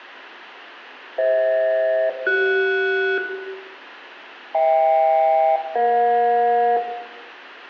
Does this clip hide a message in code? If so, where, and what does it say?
Yes: aircraft SELCAL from 1.2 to 6.8 s, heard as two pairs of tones, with room echo. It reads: FH-CS HK-EJ